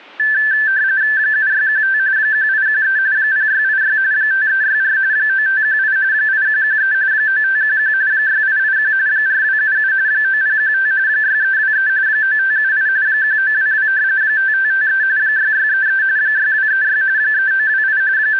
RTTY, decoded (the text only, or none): 7615 1813 0686 5364 9518 8113 9511 6881 4277 9015 6323 9578 1922 5553 6633 6236 3928 …